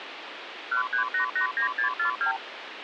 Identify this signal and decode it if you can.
Multi-frequency trunk signalling (R2, with the far end's replies), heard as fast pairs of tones, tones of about 110 ms, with phone line noise. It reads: 13889642